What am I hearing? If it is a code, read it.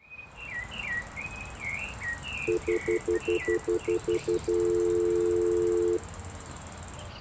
Telephone call progress tone (North American plan), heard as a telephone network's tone, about 350, 440 Hz, 0.1 s on and 0.1 s off. Stutter dial tone.